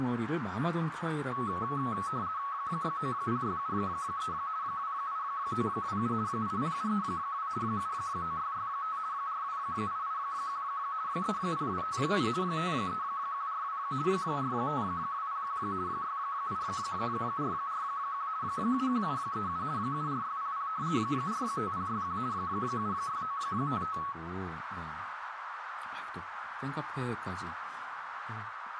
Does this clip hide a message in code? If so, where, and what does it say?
Yes: RTTY (50 baud, 170 Hz shift) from 1.3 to 24.1 s, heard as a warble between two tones, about 1200 Hz centre, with radio static, a narrow filter and speech in Korean. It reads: 90673 28927 80732 79665 42881 30257 53142 45201 68441 71737 74600 45061 76955